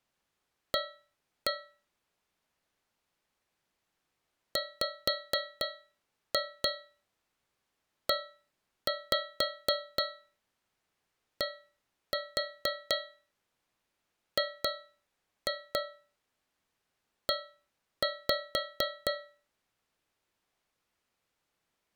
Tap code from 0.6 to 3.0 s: A

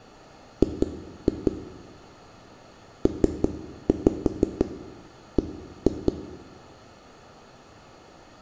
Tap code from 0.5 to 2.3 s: G

